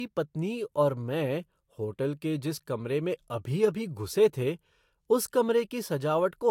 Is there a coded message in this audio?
No, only speech in Hindi.